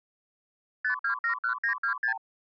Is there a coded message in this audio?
Yes: multi-frequency trunk signalling (R2, with the far end's replies) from 0.8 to 2.2 s, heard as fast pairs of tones, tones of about 100 ms. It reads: 5271926